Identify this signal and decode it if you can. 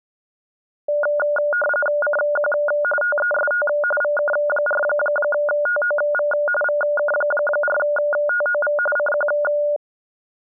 RTTY (45.45 baud, 850 Hz shift), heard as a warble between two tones, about 1010 Hz centre. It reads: CQ TEST VK4TOV VK4TOV CQ